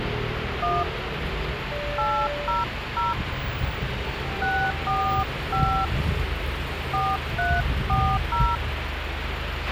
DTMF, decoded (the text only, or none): 1 800 645 4340